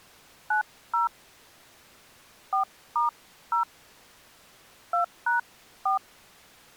DTMF, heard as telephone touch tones, dialled by hand, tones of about 150 ms. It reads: 90 4*0 2#4